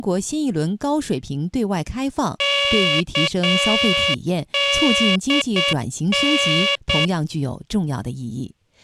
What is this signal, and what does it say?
Morse code, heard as a buzzer, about 8 wpm, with speech in Chinese. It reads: KDN